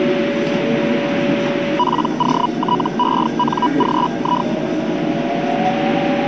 Hellschreiber (Feld-Hell, 122.5 baud), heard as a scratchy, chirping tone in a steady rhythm, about 980 Hz, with a steady whistle near 570 Hz and the noise inside a subway train. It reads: POTENGI